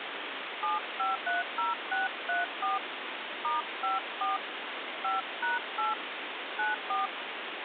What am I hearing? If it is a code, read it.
DTMF, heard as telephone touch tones, dialled by hand, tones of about 160 ms, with phone line noise. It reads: 7530634 *54 5#8 94